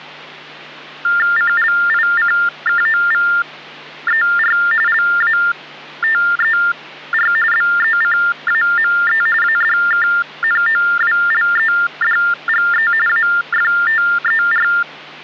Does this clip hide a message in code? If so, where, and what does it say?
Yes: TTY/TDD text telephone tones (45.45 baud Baudot) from 1.0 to 14.8 s, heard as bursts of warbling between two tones, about 400 Hz shift, 1600 Hz centre, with hum. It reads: CLICKOVER LATER BECAME ADKNOWLEDGE AFTER